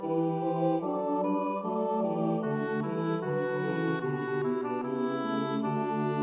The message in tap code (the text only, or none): none